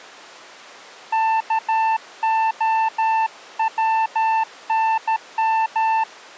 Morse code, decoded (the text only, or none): KOWNM